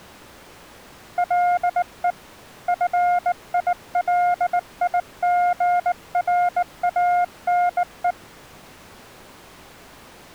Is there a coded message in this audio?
Yes: Morse code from 1.1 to 8.2 s, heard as a keyed tone, hand-sent with a bug key, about 19 wpm, 710 Hz. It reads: LE FILIGRANE